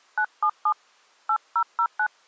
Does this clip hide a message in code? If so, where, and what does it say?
Yes: DTMF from 0.2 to 2.1 s, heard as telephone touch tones, dialled by hand, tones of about 70 ms. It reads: 977 8009